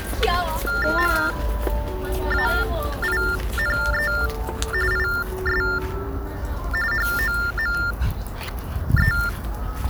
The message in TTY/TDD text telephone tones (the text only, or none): MAINE IS HOME